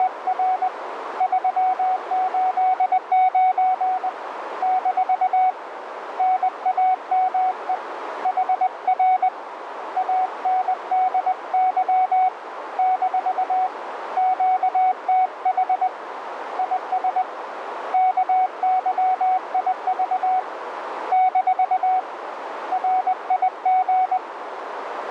Morse code, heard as a keyed tone, hand-sent with a paddle, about 20 wpm, 750 Hz, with radio static and a narrow filter. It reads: … 389 - NAME HR ANDY - QTH IS KYIV - RIG